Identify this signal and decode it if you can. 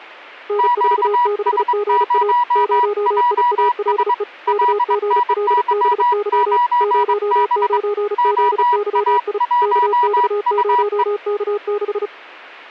Morse code, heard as two keyed tones. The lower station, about 35 wpm, 410 Hz: N46GA 0IALE KGLBY 09ZYI KX0K6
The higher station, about 22 wpm, 970 Hz: QS0JS LNY9B OA1UE